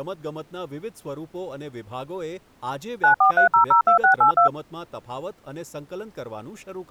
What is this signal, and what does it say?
DTMF, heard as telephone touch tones, dialled by machine, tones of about 110 ms, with speech in Gujarati. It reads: 943002682